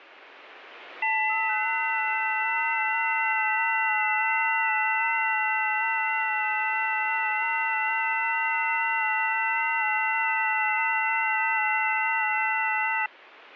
FT8 (several signals at once), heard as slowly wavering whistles, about 6.25 baud, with radio static.